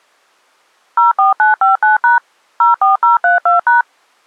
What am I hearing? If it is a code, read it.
DTMF, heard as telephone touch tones, dialled by machine, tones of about 140 ms. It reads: 04959# 04032#